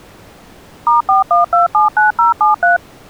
DTMF, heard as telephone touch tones, dialled by machine, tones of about 140 ms. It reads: *41279073